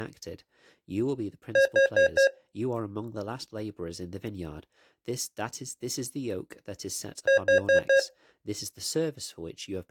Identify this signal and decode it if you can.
Alarm pattern, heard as an alarm's beeps, played twice, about 540 Hz, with speech in English. Temporal four. Carbon monoxide.